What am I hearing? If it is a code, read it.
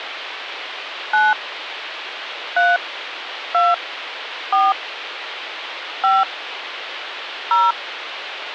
DTMF, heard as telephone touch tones, dialled by hand, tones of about 200 ms, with phone line noise. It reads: 9 3 2 4 5 0